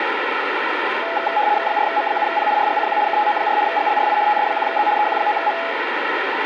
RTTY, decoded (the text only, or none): 4M7P RGCQ KTO4 GLRI TS1Z EQ9M